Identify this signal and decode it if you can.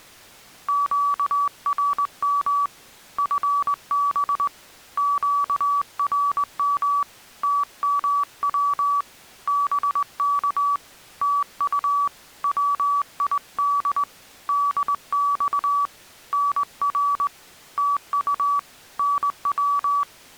Morse code, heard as a keyed tone, hand-sent with a straight key, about 20 wpm, 1140 Hz. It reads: QRM FB QRM TMW BK TU WID DX NR TU NW